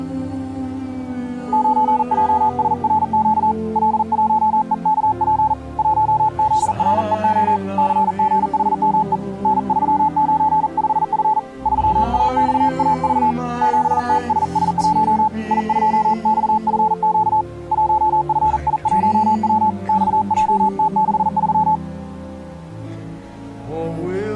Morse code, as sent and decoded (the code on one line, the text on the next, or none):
----. .--- ... .-. --.- / .-.. .---- . -.- .--. / .---- --.. .-. . --- / -.-. --. .... -- . / -. ...-- ----. ..... ..-. / ...-- .- -..- .- ...- / --... - ... ... .---- / .. ..--- -..- ..-. --.- / .---- ..-. .. .---- .-- / -..- .--- - -.... ...--
9JSRQ L1EKP 1ZREO CGHME N395F 3AXAV 7TSS1 I2XFQ 1FI1W XJT63